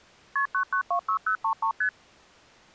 Multi-frequency trunk signalling (R1, as on North American trunks), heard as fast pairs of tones, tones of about 90 ms. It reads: KP 9926033 ST